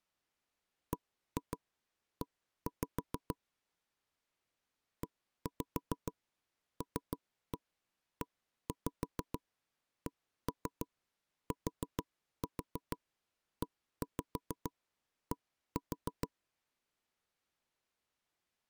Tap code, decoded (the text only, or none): BE ELECTED